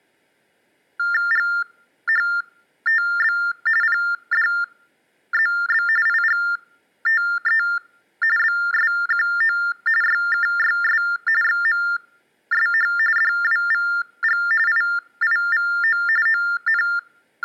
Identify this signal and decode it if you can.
TTY/TDD text telephone tones (45.45 baud Baudot), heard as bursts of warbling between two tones, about 400 Hz shift, 1600 Hz centre. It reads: GHTB PDZB IGTE BSQO YKYS XMSH DWVG IIVO …